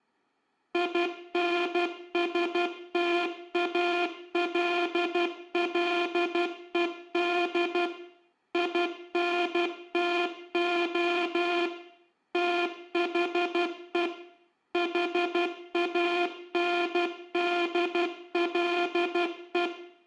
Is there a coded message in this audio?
Yes: Morse code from 0.7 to 19.7 s, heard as a buzzer, machine-sent, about 12 wpm, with room echo. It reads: INSTALLED INTO THE HANDLE